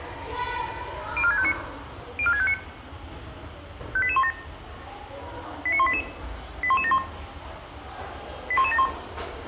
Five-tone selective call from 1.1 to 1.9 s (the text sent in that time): 04659